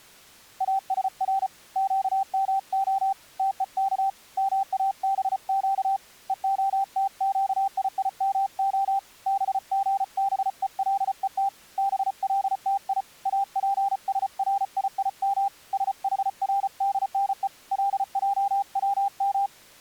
Morse code (Hebrew alphabet), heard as a keyed tone, hand-sent with a paddle, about 34 wpm, 790 Hz. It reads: אשר קמה תוך מאבק והתקיימה בגבולות בלתי אפשריים שחרדנו לעצם